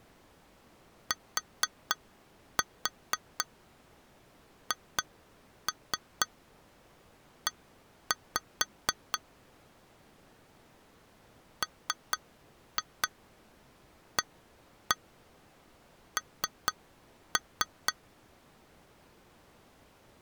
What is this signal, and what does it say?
Tap code, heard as taps on glass, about 4 knocks a second. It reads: THE MAN